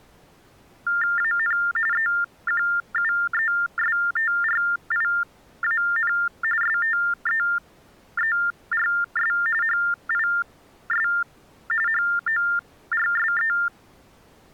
TTY/TDD text telephone tones (45.45 baud Baudot), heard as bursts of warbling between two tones, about 400 Hz shift, 1600 Hz centre. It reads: AN EQUESTRIAN STEERS HIS HORSE